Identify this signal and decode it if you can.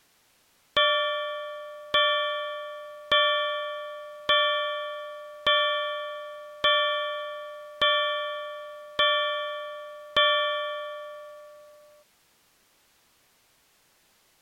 Clock strike, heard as a bell. 9. Nine o'clock.